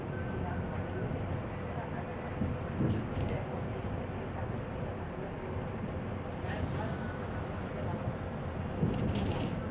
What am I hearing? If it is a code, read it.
The noise inside a bus. There is no code.